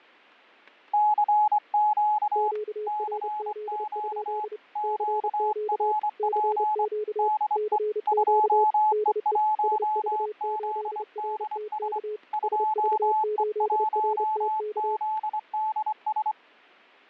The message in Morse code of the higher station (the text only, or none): CQ CQ QRP DE 2E1ZDS 2E1ZDS